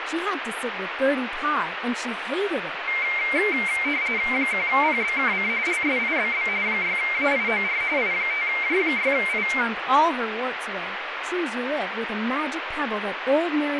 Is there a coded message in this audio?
Yes: RTTY (45.45 baud, 170 Hz shift) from 2.9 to 9.6 s, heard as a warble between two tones, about 2200 Hz centre, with radio static and speech in English. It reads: 1PBKC LSIBB 6AIOR I5J6I